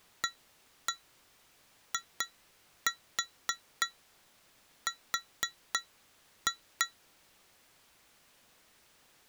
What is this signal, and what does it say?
Tap code, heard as taps on glass, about 3 knocks a second. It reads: AIR